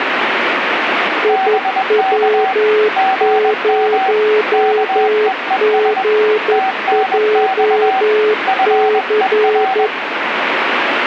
Morse code, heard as two keyed tones, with radio static. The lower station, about 11 wpm, 430 Hz: IW0GJC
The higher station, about 21 wpm, 760 Hz: BK GM KEES TNX FER